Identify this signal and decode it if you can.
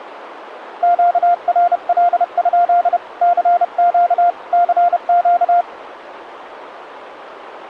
Morse code, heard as a keyed tone, hand-sent with a paddle, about 31 wpm, 700 Hz, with radio static. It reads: QRL? CQ CQ